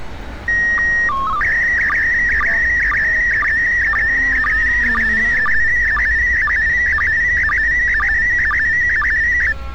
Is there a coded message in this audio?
Yes: SSTV (slow-scan television), PD 120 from 0.5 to 9.5 s, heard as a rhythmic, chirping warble, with street noise.